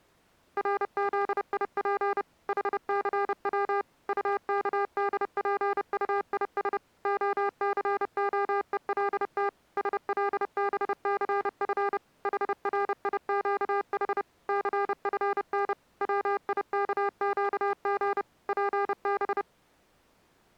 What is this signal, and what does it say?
Morse code, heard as electronic beeps, machine-sent, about 30 wpm, 400 Hz. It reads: RZIP HCW UKDPUIS OCOELT SLBCF HRIQH CFN WIKQG PB